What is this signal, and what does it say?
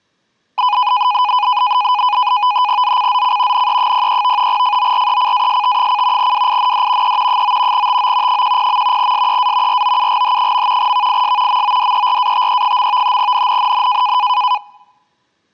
NAVTEX (SITOR-B), 100 baud, 170 Hz shift, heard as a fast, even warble, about 910 Hz centre. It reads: ZCZC NE03 FORECAST: WIND E 9 TO 10. SEA ROUGH. VIS MODERATE. NNNN